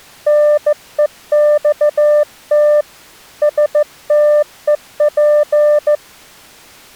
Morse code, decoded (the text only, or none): NEXT STEP